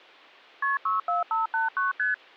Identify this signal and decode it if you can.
Multi-frequency trunk signalling (R1, as on North American trunks), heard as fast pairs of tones, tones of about 150 ms. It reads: KP 64589 ST